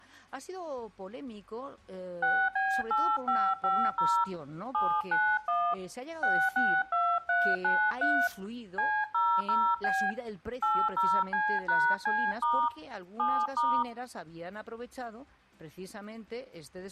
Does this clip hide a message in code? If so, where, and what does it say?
Yes: DTMF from 2.2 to 13.8 s, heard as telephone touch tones, dialled by hand, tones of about 260 ms, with room echo. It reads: 6B8550 791 662393 C00B 80C#C* 7*